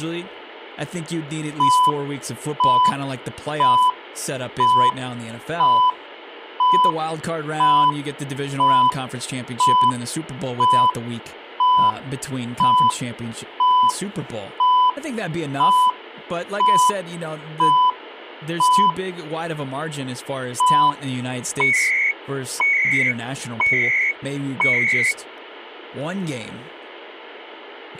Radio time signal (CHU, Canada), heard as beeps and data bursts, one a second, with speech in English.